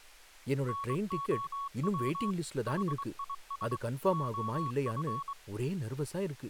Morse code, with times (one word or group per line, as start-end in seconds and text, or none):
0.7-2.3 NOW
2.7-3.8 HIS
4.1-5.3 OF